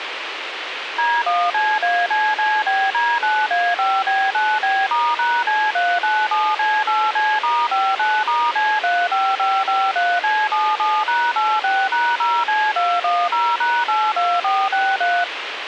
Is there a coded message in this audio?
Yes: DTMF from 1.0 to 15.2 s, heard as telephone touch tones, dialled by machine, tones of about 240 ms, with radio hiss. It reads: D1CACCBD9A5B9B*#C397C8C*59*C35553C77#86#0C210#82463